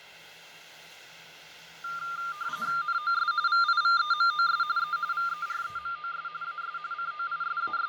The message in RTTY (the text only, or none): NOS VIVEMOS E VEREMOS AS …